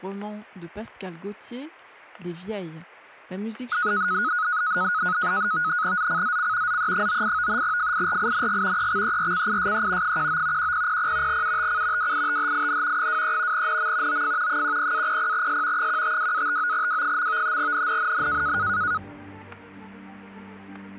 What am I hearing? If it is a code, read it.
NAVTEX (SITOR-B), 100 baud, 170 Hz shift, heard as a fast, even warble, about 1360 Hz centre, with static crashes. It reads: ZCZC ZE98 FIRING EXERCISE 19 1000 UTC WITHIN 23 NM OF 10-00S 152-59W. NNNN